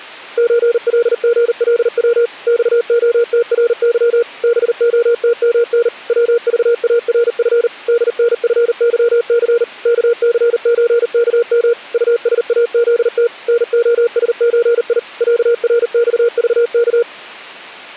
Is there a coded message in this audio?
Yes: Morse code (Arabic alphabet) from 0.3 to 17.1 s, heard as a keyed tone, machine-sent, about 39 wpm, 470 Hz. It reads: زلغلو صخترظ بختمن وضارف دنفظث كثزكم طساذت نخسزي عرصضك